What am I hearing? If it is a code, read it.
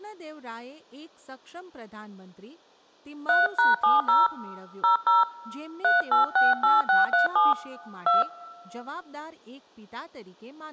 DTMF, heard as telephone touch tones, dialled by hand, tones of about 150 ms, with speech in Gujarati. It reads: 3#70 00 3868637 2